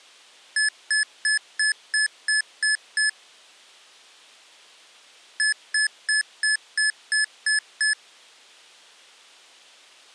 Beep code, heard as beeps from a small speaker, played twice, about 1700 Hz. 8 short. In AMI BIOS tables: display memory failure; in Dell tables: LCD failure.